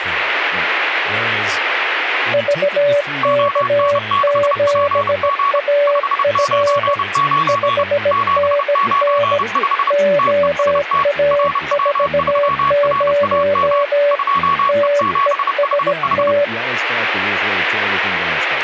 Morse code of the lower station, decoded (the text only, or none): VK7AF 5NN OA40 TEST